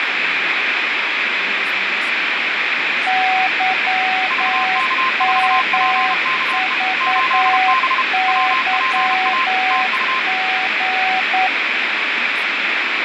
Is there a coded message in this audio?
Yes: Morse code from 3.0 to 11.5 s, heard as two keyed tones, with heavy radio static, fading and speech in English. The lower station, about 9 wpm, 750 Hz: YMVYG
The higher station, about 32 wpm, 1040 Hz: VK4PKE 8B WPA TU